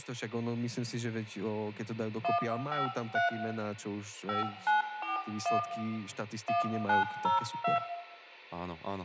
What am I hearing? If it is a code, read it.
DTMF, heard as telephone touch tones, dialled by hand, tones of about 140 ms, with room echo and speech in Slovak. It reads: 153 5941 1902